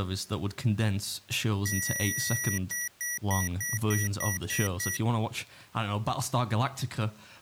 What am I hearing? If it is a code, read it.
Beep code, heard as beeps from a small speaker, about 1950 Hz, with speech in English. 1 long, 8 short. In AMI BIOS tables: display or retrace test failure.